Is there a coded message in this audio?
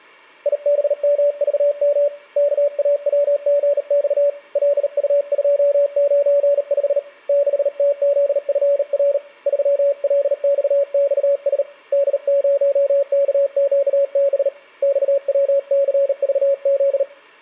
Yes: Morse code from 0.4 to 17.1 s, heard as a keyed tone, hand-sent with a bug key, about 38 wpm, 570 Hz. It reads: IBMVM KAWGX LU295 6TZFR 3LXXS D0KQB XWCVZ